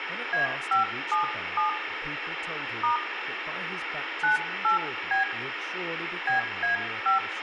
DTMF, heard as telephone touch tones, dialled by hand, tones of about 130 ms, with phone line noise, room echo and speech in English. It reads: A577 * 98B BA5